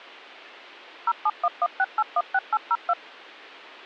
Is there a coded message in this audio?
Yes: DTMF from 1.1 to 2.9 s, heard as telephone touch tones, dialled by machine, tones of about 50 ms. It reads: 07116816802